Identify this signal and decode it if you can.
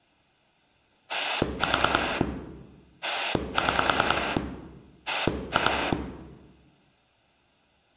Pulse dialling, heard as a rotary dial, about 10 pulses a second, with room echo. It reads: 4 6 2